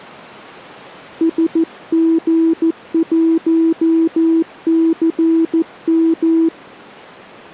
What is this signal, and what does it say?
Morse code, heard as a keyed tone, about 14 wpm, 330 Hz. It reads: SG1CM